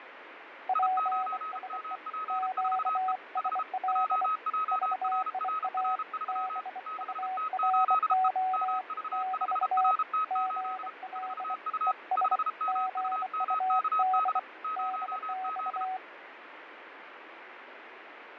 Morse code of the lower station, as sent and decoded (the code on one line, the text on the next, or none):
.--. ... . / --.- ... .-.. / ...- .. .- / -... ..- .-. --- / -...- / --. .-.. / . ... / --. ..- -.. / -.. -..-
PSE QSL VIA BURO <BT> GL ES GUD DX